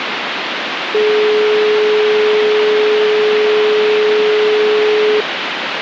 Telephone call progress tone (425 Hz plan, as in most of Europe), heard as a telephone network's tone, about 420 Hz, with phone line noise. Dial tone.